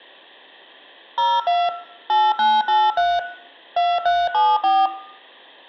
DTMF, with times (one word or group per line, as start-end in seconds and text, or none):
1.2-1.7 02
2.1-3.2 8983
3.8-4.9 2374